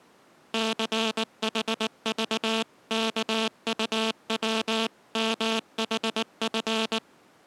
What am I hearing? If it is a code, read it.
Morse code (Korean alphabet), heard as a buzzer, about 19 wpm. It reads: 출입문